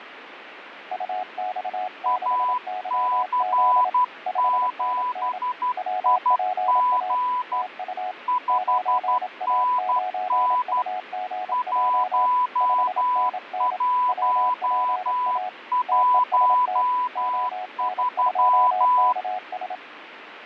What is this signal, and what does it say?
Morse code, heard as two keyed tones, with radio static. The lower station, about 27 wpm, 740 Hz: UX6YZ 5NN WPA TU 9A9UGJ 5NN WPA TEST ON2KS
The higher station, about 12 wpm, 1000 Hz: AC7IG 5NN 1113